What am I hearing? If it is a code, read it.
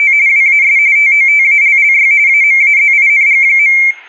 RTTY (45.45 baud, 170 Hz shift), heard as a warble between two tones, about 2200 Hz centre. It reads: … WAS TOTALLY AMAZING.